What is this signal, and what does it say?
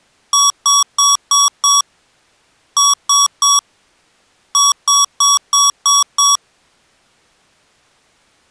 Beep code, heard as beeps from a small speaker, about 1130 Hz. 5-3-6.